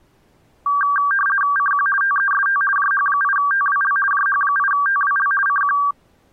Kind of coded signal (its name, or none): RTTY